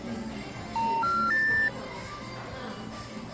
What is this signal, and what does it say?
Telephone call progress tone (North American plan), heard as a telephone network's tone, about 910, 1370, 1800 Hz, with the noise of a cafe. Special information tone.